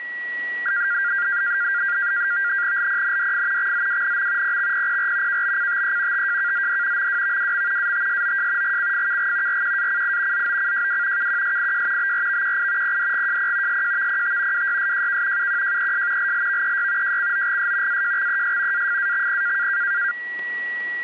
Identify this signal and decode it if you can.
NAVTEX (SITOR-B), 100 baud, 170 Hz shift, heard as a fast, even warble, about 1500 Hz centre, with a steady whistle near 1930 Hz. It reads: LPNDF XZWNM PXPPR KBCTE TJKZD MWVWM ATSOJ GCFKG RQACI ZOCJW KQSIJ BRVQI PDGJP SJVPT WYSJK UQJES LLVEY JCOGS AJXES AFAXP